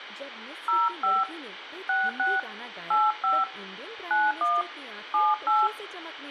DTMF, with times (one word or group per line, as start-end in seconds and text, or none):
0.7-1.2 05
1.9-2.4 66
2.9-3.4 85
4.1-4.6 91
5.1-5.7 78